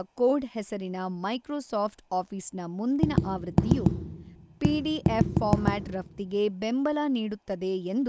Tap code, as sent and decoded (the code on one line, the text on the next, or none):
2-3 1-5
HE